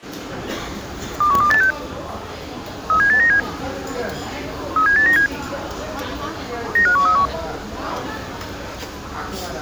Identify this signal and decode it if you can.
Five-tone selective call (CCIR), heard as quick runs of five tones, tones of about 100 ms, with the noise of a restaurant. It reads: 21286 37897 37897 95131